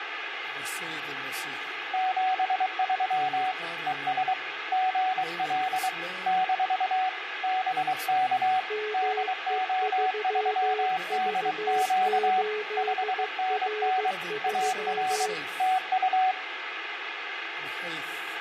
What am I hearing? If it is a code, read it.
Morse code, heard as two keyed tones, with radio static. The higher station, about 23 wpm, 750 Hz: 73 ES GL - BK DO3DQ 5NN AR TU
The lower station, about 15 wpm, 430 Hz: ME3V8R3